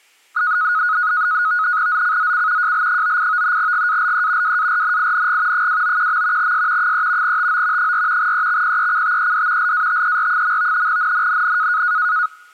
NAVTEX (SITOR-B), 100 baud, 170 Hz shift, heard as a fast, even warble, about 1360 Hz centre. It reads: ZCZC JL98 GALE WARNING 291. S 3 TO 4 EXPECTED LATER. NNNN